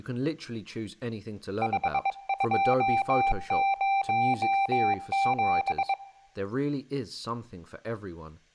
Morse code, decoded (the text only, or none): 5207